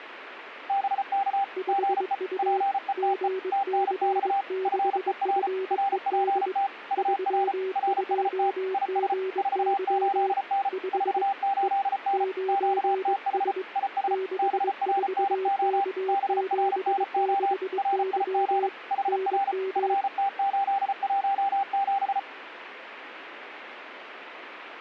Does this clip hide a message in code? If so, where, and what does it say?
Yes: Morse code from 0.6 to 22.3 s, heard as two keyed tones, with radio static. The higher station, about 34 wpm, 790 Hz: BK GE PETE TNX FER RPT UR RST IS 48N 48N QTH IS BRNO BRNO RIG HR FT817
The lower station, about 22 wpm, 380 Hz: 5U GC6FED 32GY 5 E 9S 64K76Y NM